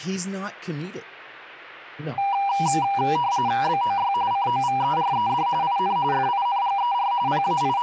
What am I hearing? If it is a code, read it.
RTTY (45.45 baud, 170 Hz shift), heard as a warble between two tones, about 880 Hz centre, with speech in English. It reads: BOY COVERED IN FINGER …